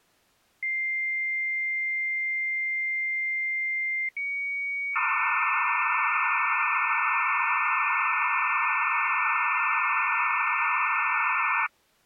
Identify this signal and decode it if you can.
Dial-up modem handshake (low-speed, two carriers), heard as two whistles, then hiss.